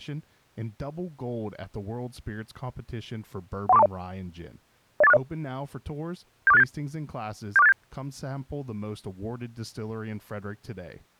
Five-tone selective call (EIA), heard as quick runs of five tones, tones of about 30 ms, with speech in English. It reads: 13420 08460 74687 74687